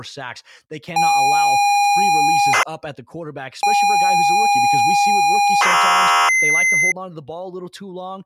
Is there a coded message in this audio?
Yes: ZX Spectrum tape loading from 1.0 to 6.9 s, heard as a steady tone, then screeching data, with speech in English.